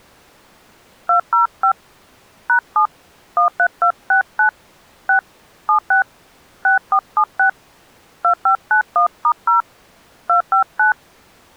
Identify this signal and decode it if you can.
DTMF, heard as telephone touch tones, dialled by hand, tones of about 100 ms. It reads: 205 #7 13269 6 76 6476 2591*0 259